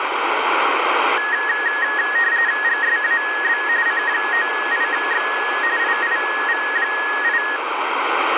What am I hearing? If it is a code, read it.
RTTY (45.45 baud, 170 Hz shift), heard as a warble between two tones, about 1800 Hz centre, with radio static. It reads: GSAB C98X IIV8